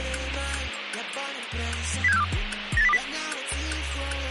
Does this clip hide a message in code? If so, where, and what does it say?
Yes: five-tone selective call (EEA) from 2.0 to 3.0 s, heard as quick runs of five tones, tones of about 40 ms, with radio hiss. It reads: 07642 98020